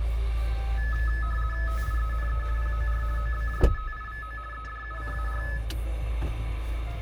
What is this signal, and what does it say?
RTTY (50 baud, 450 Hz shift), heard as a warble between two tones, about 1500 Hz centre, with radio static and the noise inside a car. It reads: TIENE POR OBJETIVO EDUCAR